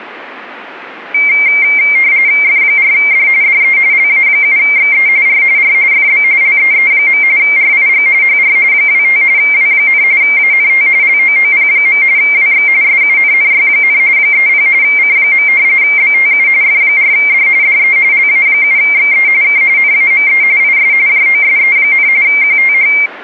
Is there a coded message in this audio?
Yes: RTTY (45.45 baud, 170 Hz shift) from 1.1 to 23.1 s, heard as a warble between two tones, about 2200 Hz centre. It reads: F4D DE LA7XE R R FB LEE. RIG HR 25 W, ANT LOOP. WX SUNNY, 30 C. BTU F4D DE LA7XE K NAME IS JOSE, QTH